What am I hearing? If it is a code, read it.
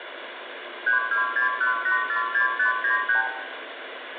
Multi-frequency trunk signalling (R2, with the far end's replies), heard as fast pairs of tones, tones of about 120 ms, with phone line noise and room echo. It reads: 3261846593